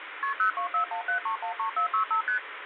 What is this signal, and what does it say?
Multi-frequency trunk signalling (R1, as on North American trunks), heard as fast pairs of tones, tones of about 100 ms, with phone line noise. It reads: KP 02417313465 ST